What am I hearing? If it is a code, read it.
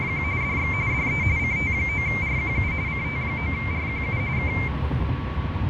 RTTY (45.45 baud, 170 Hz shift), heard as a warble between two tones, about 2200 Hz centre, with radio static and the noise inside a car. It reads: … DX DE CT9RQU CT9RQU K